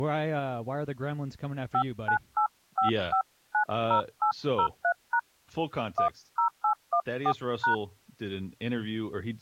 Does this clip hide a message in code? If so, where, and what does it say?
Yes: DTMF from 1.7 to 7.7 s, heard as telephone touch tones, dialled by hand, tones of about 90 ms, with speech in English. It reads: 5985590803# 10814#